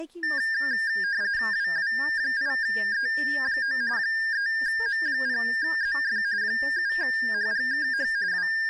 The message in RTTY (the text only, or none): WW8E9 3M0ZF 7HGKH …